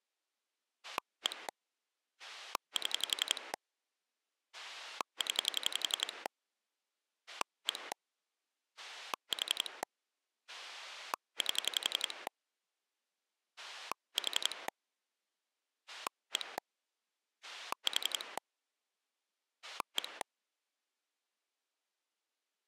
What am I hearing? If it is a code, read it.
Pulse dialling, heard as a rotary dial, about 11 pulses a second. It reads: 1 7 0 1 4 8 4 1 4 1